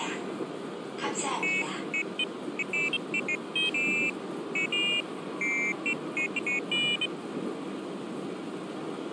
Pairs of high tones at irregular times, with the noise inside a subway train. There is no code.